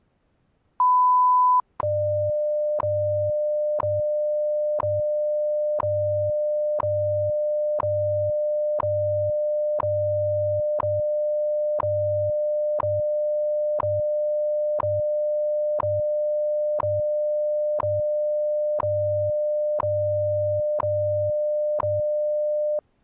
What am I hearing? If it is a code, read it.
Radio time signal (WWV, Colorado), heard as ticks, one a second.